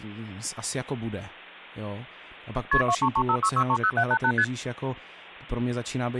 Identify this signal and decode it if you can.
Multi-frequency trunk signalling (R1, as on North American trunks), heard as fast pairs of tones, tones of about 70 ms, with hum and speech in Czech. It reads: KP 23356630788 ST